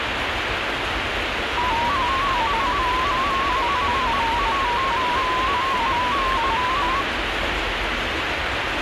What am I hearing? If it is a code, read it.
Multi-tone FSK (Olivia or MFSK type), about 250 Hz wide, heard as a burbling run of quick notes, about 15.625 baud, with radio static and the noise of a park.